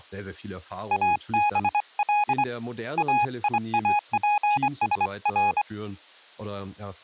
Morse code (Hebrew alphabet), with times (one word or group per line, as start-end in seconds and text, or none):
0.9-2.4 אבל
3.0-5.6 איאפשר